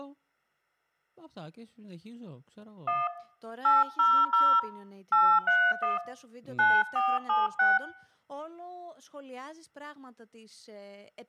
DTMF, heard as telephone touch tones, dialled by hand, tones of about 200 ms, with room echo and speech in Greek. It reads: 1 800 831 9476